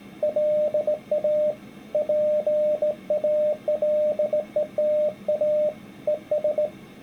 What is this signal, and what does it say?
Morse code, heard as a keyed tone, hand-sent with a straight key, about 18 wpm, 600 Hz. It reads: LA PALETA ES